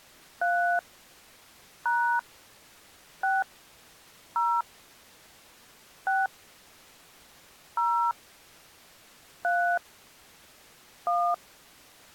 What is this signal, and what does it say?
DTMF, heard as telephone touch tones, dialled by hand, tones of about 290 ms. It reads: 3 # 6 0 6 0 3 1